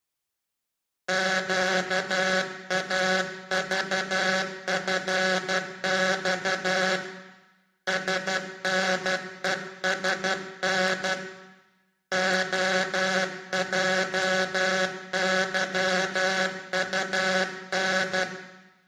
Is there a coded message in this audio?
Yes: Morse code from 1.0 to 18.3 s, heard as a buzzer, hand-sent with a paddle, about 12 wpm, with room echo. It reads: QAVFX SNESN OJYUN